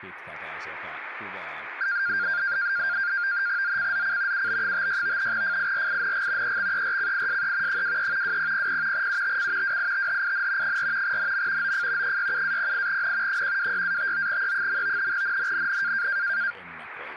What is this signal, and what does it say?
NAVTEX (SITOR-B), 100 baud, 170 Hz shift, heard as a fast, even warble, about 1500 Hz centre, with radio static and speech in Finnish. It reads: ZCZC UB56 FIRING EXERCISE 23 2000 UTC WITHIN 4 NM OF 67-08N 126-59E. NNNN